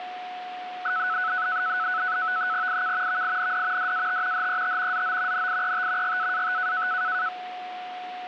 NAVTEX (SITOR-B), 100 baud, 170 Hz shift, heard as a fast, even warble, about 1400 Hz centre, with radio static and a steady whistle near 730 Hz. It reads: IK VIND DAT HET ZO NIET GAAT